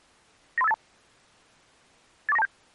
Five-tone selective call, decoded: 93582 84927

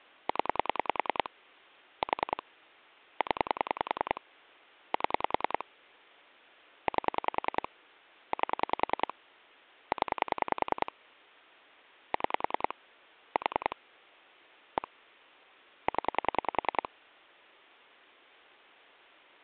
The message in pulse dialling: 0 4 0 7 8 8 0 6 4 1 0

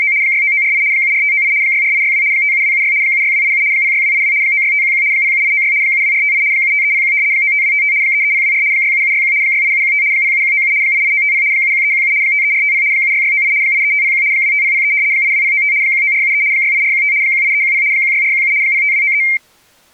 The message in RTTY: … 69948 74598 64862 57276 76287 06282 96511 07896 72458 75301 95255 33024 67761 68715 07197 88950 71317 53450 76698 83501 25003 82095 19473 68415 18310 16417 05293

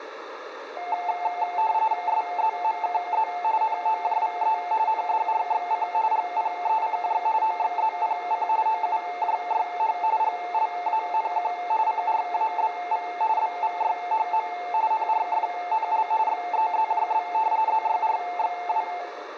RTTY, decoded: SZMKZ NOJVE NDRXC GPECJ OXZPC OUJYH GLANQ CRABV BVYHM NRFNL XEZJB ZYRXW

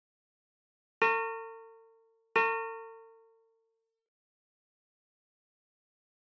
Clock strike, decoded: 2

